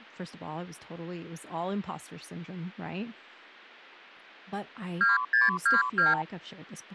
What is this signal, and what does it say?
Multi-frequency trunk signalling (R2, with the far end's replies), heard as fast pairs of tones, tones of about 160 ms, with speech in English. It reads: 2622